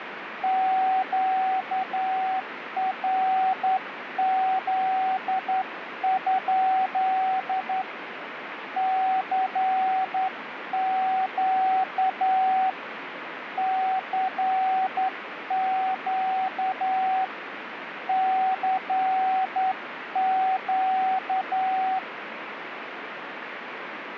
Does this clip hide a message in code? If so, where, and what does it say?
Yes: Morse code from 0.4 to 22.0 s, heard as a keyed tone, hand-sent with a straight key, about 10 wpm, 760 Hz, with radio static. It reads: QRZ? CQ CQ CQ